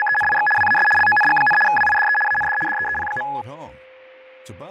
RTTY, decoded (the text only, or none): … WAS LONG, WIDE AND DEEP.